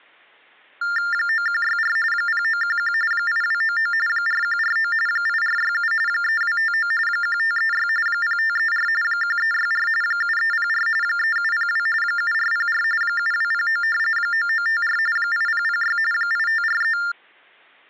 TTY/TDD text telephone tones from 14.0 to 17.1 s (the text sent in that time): 9954 8006 8543